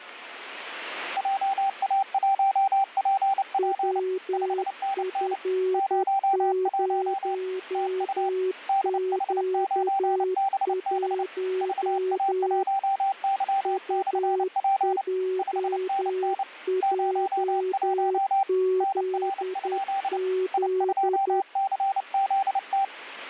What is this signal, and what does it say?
Morse code, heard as two keyed tones, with radio static. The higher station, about 29 wpm, 780 Hz: JA1PP 5NN 01 TU DH9BB VA1Y/P 5NN 01 NR? I2CZT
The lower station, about 10 wpm, 370 Hz: WF0Q1 UJJZZ